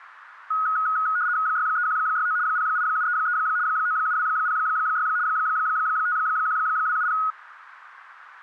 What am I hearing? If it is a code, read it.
RTTY (75 baud, 170 Hz shift), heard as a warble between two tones, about 1360 Hz centre, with radio static. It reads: 63169 08733 97206 51270